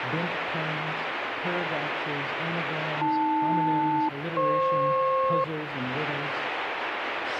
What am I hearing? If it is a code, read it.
Aircraft SELCAL, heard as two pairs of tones, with radio static. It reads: AL-FP